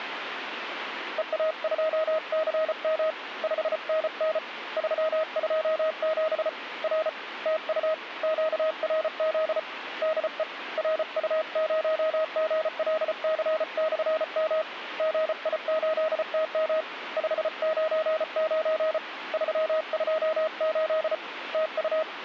Morse code, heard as a keyed tone, hand-sent with a paddle, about 34 wpm, 630 Hz, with radio static. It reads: EA2CM 5NN 327 R TU QRZ DE RU0GLC/M GI8TM 599 328 TU